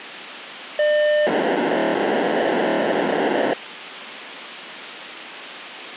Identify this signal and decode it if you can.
POCSAG pager data (1200 baud), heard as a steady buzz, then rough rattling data, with radio hiss.